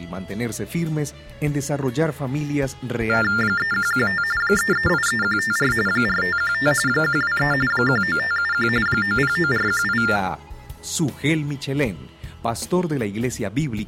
TTY/TDD text telephone tones (45.45 baud Baudot), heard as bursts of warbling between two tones, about 400 Hz shift, 1600 Hz centre. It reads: 3115 3383154 4515 123 19571 909418